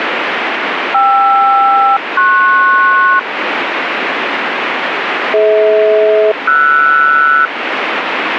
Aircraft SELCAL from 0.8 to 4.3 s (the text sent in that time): KR-PS